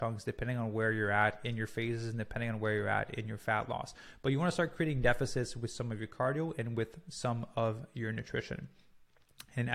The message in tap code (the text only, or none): none